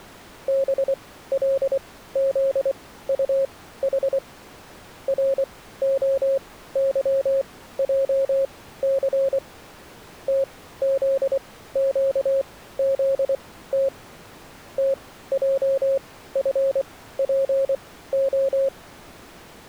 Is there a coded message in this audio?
Yes: Morse code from 0.4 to 18.7 s, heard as a keyed tone, machine-sent, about 24 wpm, spaced as for 15 wpm, 540 Hz. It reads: BLZUH ROYJC TZQZT TJFPO